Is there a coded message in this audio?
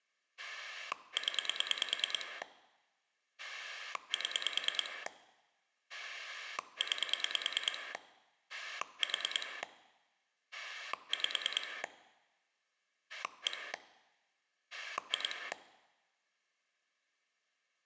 Yes: pulse dialling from 0.4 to 15.5 s, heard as a rotary dial, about 9 pulses a second. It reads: 0 7 9 4 5 1 2